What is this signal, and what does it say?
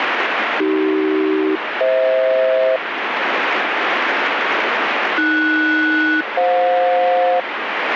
Aircraft SELCAL, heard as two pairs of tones, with radio static. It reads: AC-FH AS-FJ